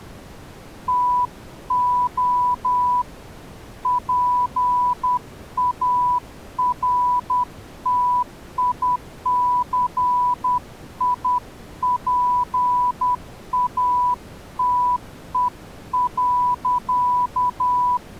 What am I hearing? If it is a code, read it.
Morse code, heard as a keyed tone, hand-sent with a paddle, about 10 wpm, 990 Hz. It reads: TO PARTICIPATE.